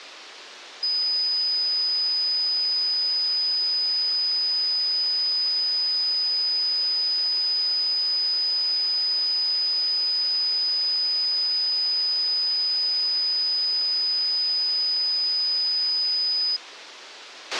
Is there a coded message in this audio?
No, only a steady tone, with a squelch burst at the end.